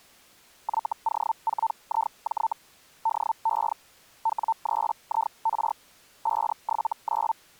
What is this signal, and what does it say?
Hellschreiber (Feld-Hell, 122.5 baud), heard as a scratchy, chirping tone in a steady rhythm, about 900 Hz. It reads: YO4IJ DE W3IR 579